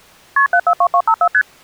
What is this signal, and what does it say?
Multi-frequency trunk signalling (R1, as on North American trunks), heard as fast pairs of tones, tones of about 70 ms. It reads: KP 742254 ST